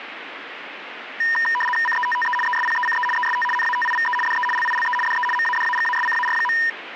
RTTY (75 baud, 850 Hz shift), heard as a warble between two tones, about 1410 Hz centre, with radio static. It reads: CETTE ESPECE EST NATIVE DE LILE DE MADAGASCAR.